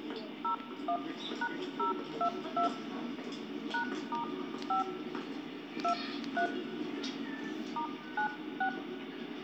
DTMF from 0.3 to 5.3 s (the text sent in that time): 01#022 #*5